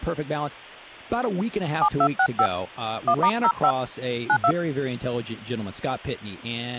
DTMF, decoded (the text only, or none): 7265 1*05 92